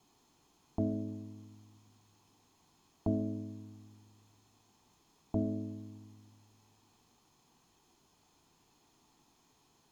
Clock strike, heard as a bell, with room echo. 3. Three o'clock.